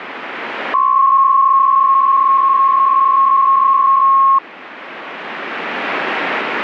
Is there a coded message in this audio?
Yes: PSK63 (62.5 baud) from 0.7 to 4.4 s, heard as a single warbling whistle, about 1080 Hz.